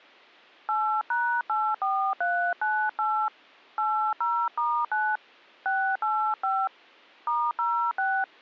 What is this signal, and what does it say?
DTMF, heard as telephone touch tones, dialled by hand, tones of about 290 ms. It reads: 8#84398 80*9 685 *06